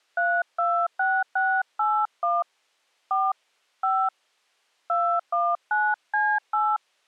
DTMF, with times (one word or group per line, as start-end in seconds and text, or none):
0.2-2.4 326681
3.1-3.3 4
3.8-4.1 5
4.9-6.8 219C8